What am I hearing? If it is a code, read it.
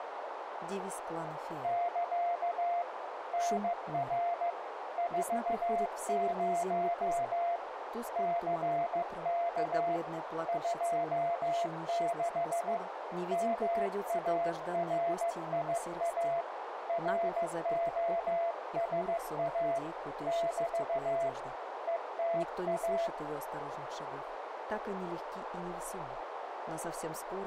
Morse code, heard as a keyed tone, hand-sent with a paddle, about 15 wpm, 680 Hz, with radio static and a narrow filter. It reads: <KA> NR 40 CK 26 MARIA ROSA <BT> ETA